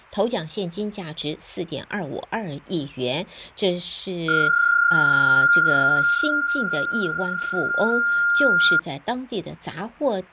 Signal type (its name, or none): PSK31